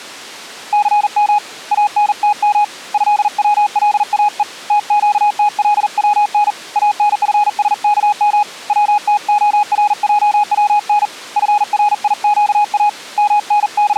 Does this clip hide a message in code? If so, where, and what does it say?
Yes: Morse code (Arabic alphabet) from 0.7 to 14.0 s, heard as a keyed tone, hand-sent with a paddle, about 40 wpm, 830 Hz. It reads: ثم انتم هولاء تقتلون انفسكم وتخرجون فريقا …